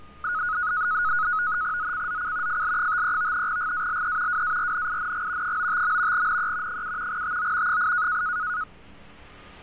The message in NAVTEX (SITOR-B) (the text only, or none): ZCZC FL53 GALE WARNING 95. NE 7 TO 8